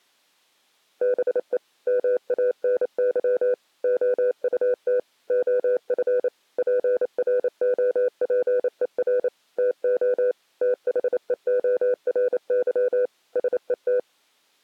Morse code, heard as a keyed tone, machine-sent, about 28 wpm, 500 Hz. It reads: BE MANY OUT OF PROPER TO THEORY SET